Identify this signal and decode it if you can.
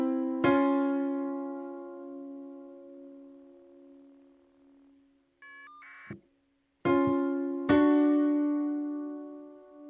Caller ID data burst, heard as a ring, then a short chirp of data, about 1200 baud.